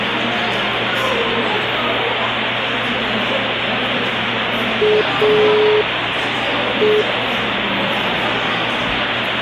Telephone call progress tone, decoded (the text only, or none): dial tone